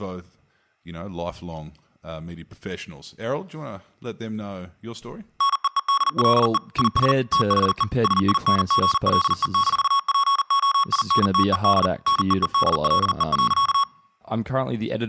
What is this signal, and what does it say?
Morse code, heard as electronic beeps, machine-sent, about 40 wpm, 1110 Hz, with speech in English. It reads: NEEDLE IS THE SINGLE-POINTED NEEDLE.